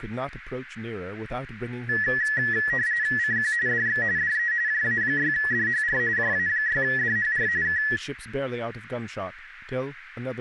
RTTY (45.45 baud, 170 Hz shift), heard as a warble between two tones, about 1800 Hz centre, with radio static and speech in English. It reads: CQ DX DE JA6DHR JA6DHR K